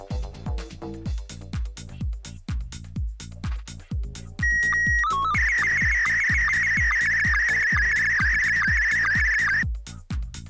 SSTV (slow-scan television), Scottie S1, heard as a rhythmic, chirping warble.